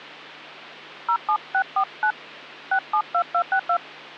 DTMF, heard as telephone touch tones, dialled by hand, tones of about 80 ms, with hum. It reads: 07649 672262